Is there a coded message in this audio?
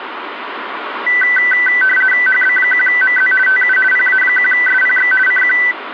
Yes: RTTY (50 baud, 450 Hz shift) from 1.1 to 5.7 s, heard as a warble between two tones, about 1750 Hz centre, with radio static. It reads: HB1MZ TU PA1SPX CQ